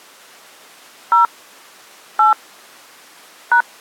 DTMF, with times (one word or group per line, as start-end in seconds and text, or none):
1.1-1.3 0
2.2-2.3 8
3.5-3.6 #